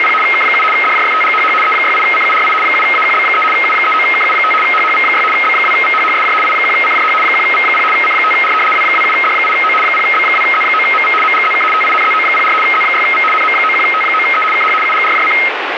RTTY (75 baud, 850 Hz shift), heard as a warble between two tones, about 1700 Hz centre, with radio static. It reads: … K7 DJFTGHH E68CURI 7AQB3 U39KU5 HHV6 B2VHHSJ I1CJH 1V0 C5R W27D8O 0B2Z9MV MGZK TINZO04 Z6V NM91T9E KH UGRJC